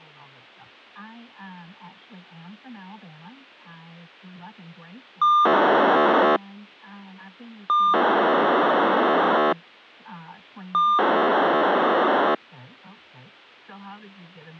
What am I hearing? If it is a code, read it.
POCSAG pager data (2400 baud), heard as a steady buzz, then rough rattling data.